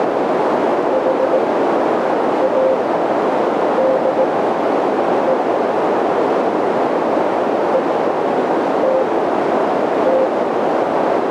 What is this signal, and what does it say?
Morse code, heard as a keyed tone, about 18 wpm, spaced as for 7 wpm, 520 Hz, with heavy radio static and a narrow filter. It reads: HADE ETT